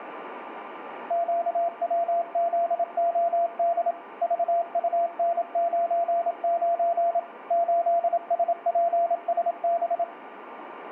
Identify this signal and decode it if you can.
Morse code, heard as a keyed tone, machine-sent, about 27 wpm, 680 Hz, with radio static and a steady whistle near 1190 Hz. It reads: QWZOD VUN99 8SPSB